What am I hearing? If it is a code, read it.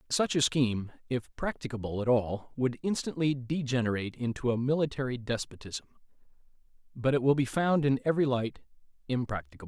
Speech in English. There is no code.